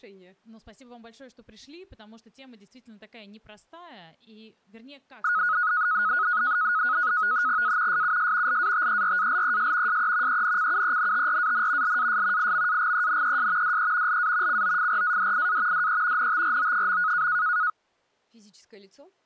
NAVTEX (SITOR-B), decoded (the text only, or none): A SUS LATERALES SE ENCUENTRAN LAS IMAGENES DE LA COFRADIA DE NTRO.